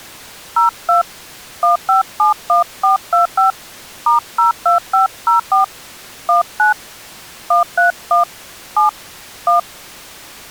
DTMF, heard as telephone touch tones, dialled by hand, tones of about 130 ms. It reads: 02 1571425 *02504 19 131 7 1